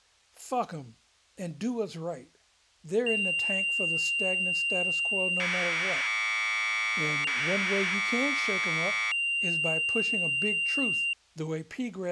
Commodore tape loading (standard loader), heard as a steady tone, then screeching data, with speech in English.